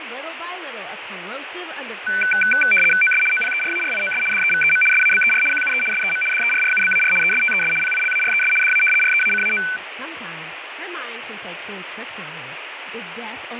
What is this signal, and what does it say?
RTTY (75 baud, 850 Hz shift), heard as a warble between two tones, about 1900 Hz centre, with radio static, fading and speech in English. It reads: OS OPERARIOS DEVEM SABER QUE SEM DERRUBAR ESTES PILARES DA REACAO